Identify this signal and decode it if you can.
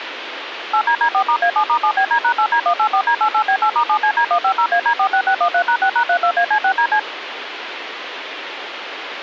DTMF, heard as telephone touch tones, dialled by machine, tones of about 80 ms, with radio hiss. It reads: 8DD4*A7*7BD#8D184D88B8*7CD150AD46613#6#32AC6DC